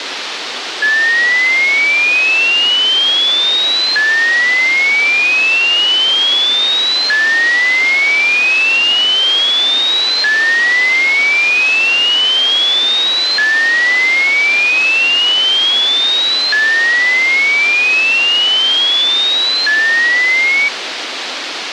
A tone that sweeps in pitch again and again, with radio hiss. There is no code.